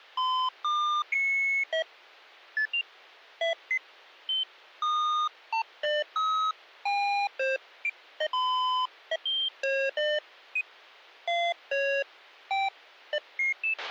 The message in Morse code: none

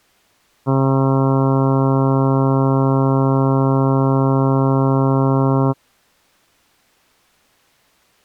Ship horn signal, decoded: 1 long

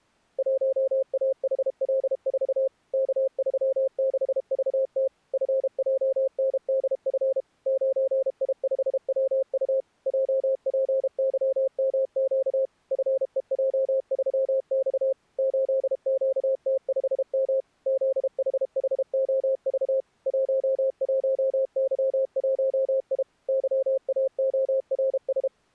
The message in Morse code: 1AHL4 K36VT FJNDF 9I5WU JPYMQ FEJ3X 8QT5M ZHHOV 11Y1I YAORS

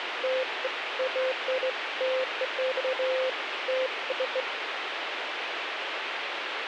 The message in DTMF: none

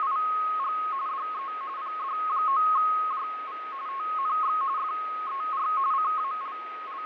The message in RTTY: … DE PD9JV TNX FER …

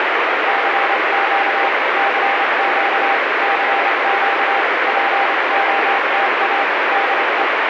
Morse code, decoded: CQ CQ CQ POTA DE

